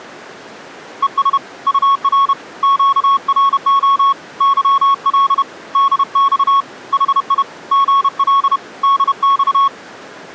Morse code, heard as a keyed tone, hand-sent with a paddle, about 31 wpm, 1100 Hz. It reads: ES UR QRO YL DX HI GL DX